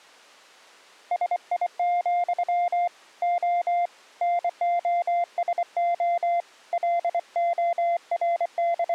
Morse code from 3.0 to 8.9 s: O NOSO …

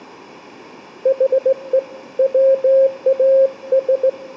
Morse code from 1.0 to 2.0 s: HE

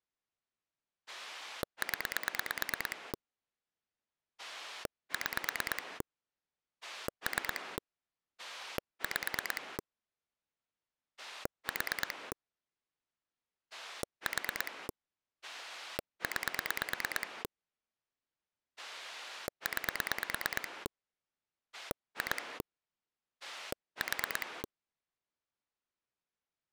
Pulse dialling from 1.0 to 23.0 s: 0 6 3 5 4 4 9 9 2

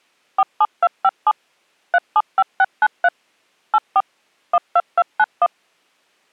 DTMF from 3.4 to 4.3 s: 84

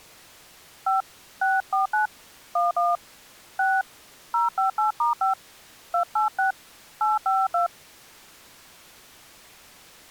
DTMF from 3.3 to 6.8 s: 6 058*5 286

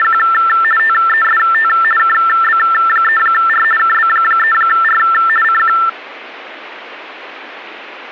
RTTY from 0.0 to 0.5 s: …

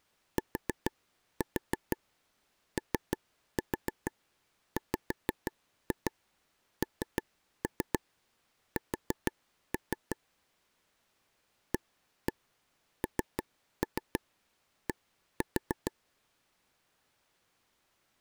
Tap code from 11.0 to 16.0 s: AND

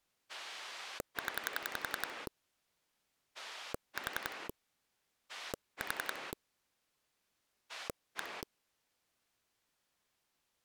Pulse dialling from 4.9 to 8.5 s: 4 1

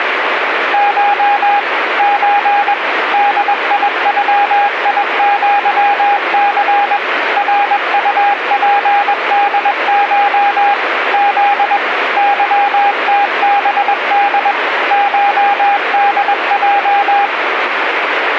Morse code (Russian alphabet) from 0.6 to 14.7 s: Ш Ч ДИЮИЪЦ РУПДШ З ЫТБД

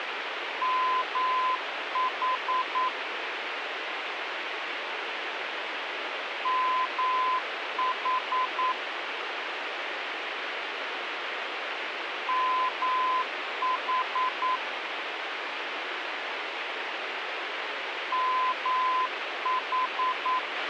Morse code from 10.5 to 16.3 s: MH

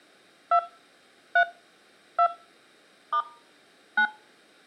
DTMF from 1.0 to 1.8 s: 3

